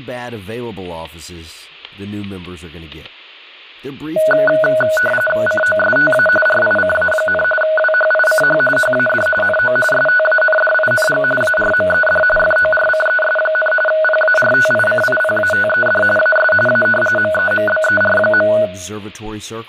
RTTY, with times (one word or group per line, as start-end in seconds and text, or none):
5.5-6.3 COSTA
6.5-7.4 RICA,
7.6-8.6 WHICH
8.8-9.3 HAD
9.4-9.8 NO
9.9-11.2 STANDING
11.4-12.2 ARMED
12.4-13.7 FORCES,
13.9-16.0 PARTICIPATED
16.2-16.5 AS
16.7-16.9 A
17.2-18.5 MEMBER.